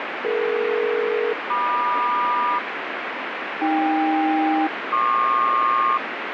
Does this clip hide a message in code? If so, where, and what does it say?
Yes: aircraft SELCAL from 0.2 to 6.0 s, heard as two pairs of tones, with heavy radio static. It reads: DE-MQ AK-PQ